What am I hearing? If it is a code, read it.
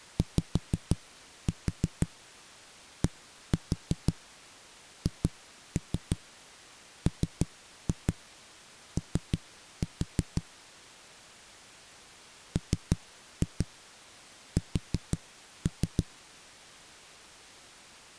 Tap code, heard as knocks on a wall, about 6 knocks a second. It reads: YDHMO MS